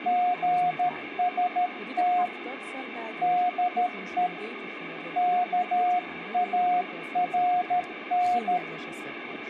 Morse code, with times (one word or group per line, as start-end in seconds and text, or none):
0.1-2.3 GST
3.2-4.3 DE
5.2-8.6 KARN